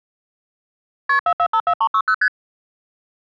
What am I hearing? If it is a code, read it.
Multi-frequency trunk signalling (R1, as on North American trunks), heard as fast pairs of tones, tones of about 70 ms. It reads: KP 4454360 ST